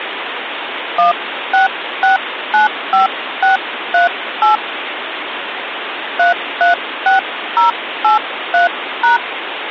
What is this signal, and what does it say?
DTMF, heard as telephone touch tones, dialled by hand, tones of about 130 ms, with phone line noise. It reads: 16695638 336083#